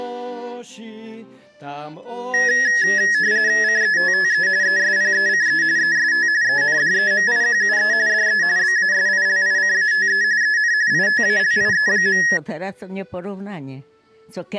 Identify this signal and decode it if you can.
RTTY (45.45 baud, 170 Hz shift), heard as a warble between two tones, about 1800 Hz centre. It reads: CETTE ESPECE EST ENDEMIQUE DE BASILICATE EN ITALIE.